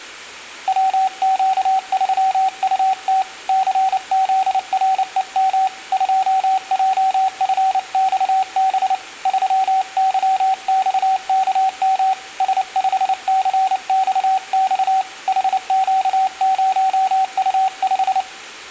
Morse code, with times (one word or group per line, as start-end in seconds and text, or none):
0.7-3.2 WQ3UT
3.5-5.7 CZREM
5.9-8.9 2JFXB
9.3-12.1 3YXKM
12.4-15.0 S5CXX
15.3-18.2 HQ0U5